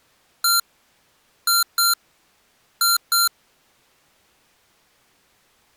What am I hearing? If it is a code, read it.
Beep code, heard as beeps from a small speaker, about 1380 Hz. 1-2-2. In Phoenix BIOS tables: DMA initialisation failure.